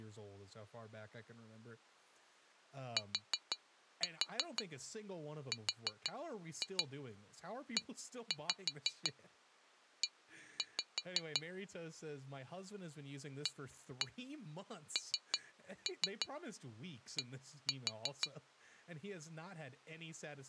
Tap code, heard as taps on glass, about 6 knocks a second, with speech in English. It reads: TREE AND